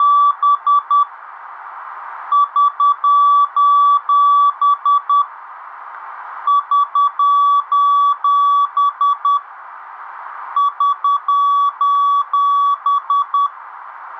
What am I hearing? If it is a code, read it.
Morse code, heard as a keyed tone, hand-sent with a paddle, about 10 wpm, 1150 Hz. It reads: … <SOS> <SOS> <SOS>